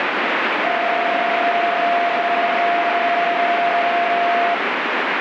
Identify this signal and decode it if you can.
PSK31 (31.25 baud), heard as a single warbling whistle, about 690 Hz, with radio static.